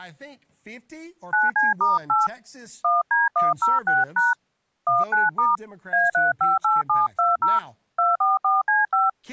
DTMF, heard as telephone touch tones, dialled by hand, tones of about 170 ms, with speech in English. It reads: 9C*8 1D106# 19* A358720 244C5